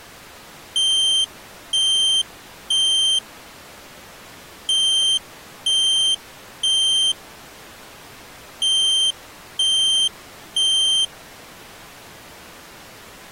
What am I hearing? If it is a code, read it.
Alarm pattern, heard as an alarm's beeps, played three times, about 3150 Hz. Temporal three. Smoke or fire, evacuate.